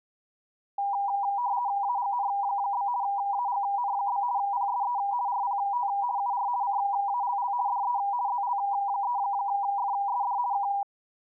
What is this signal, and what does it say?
RTTY (50 baud, 170 Hz shift), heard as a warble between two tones, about 890 Hz centre. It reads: AGN? AGN? PSE RPT UR CALL DE ZL3FSD K